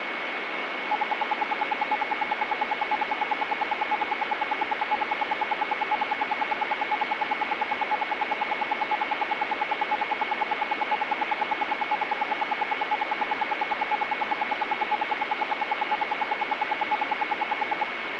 Radio time signal (RWM, Moscow), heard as ten pulses a second, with radio static and a steady whistle near 2200 Hz.